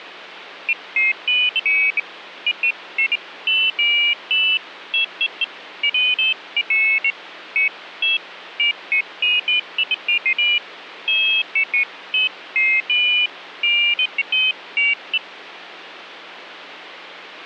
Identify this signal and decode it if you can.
Pairs of high tones at irregular times, with phone line noise. There is no code.